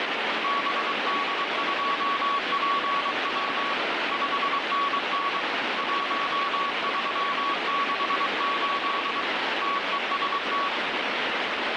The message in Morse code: BD2PW 5NN 1368 TEST

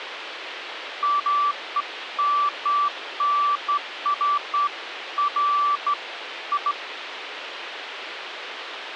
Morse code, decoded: none

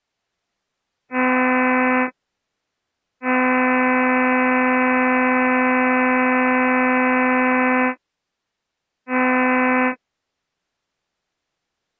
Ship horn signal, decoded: 1 short, 1 long, 1 short

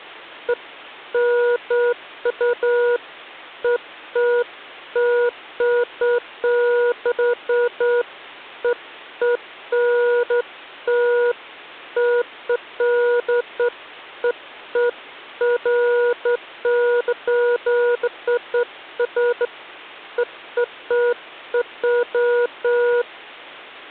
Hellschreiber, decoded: none

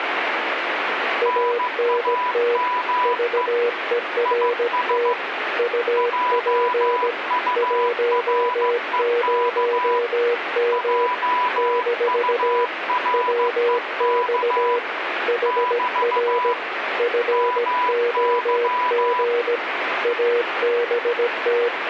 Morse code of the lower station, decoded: ANT VERT UP 10M - WX HR FOG ABT

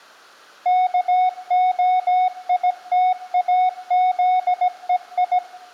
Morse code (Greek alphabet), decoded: ΚΟΙΤΑΖΕΙ

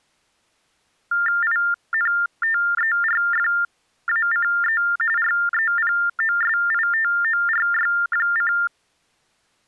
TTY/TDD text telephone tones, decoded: INTERFACE REPOSITORY:

